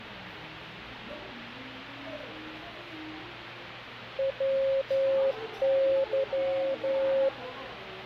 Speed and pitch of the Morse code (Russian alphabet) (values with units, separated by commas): 11 wpm, 540 Hz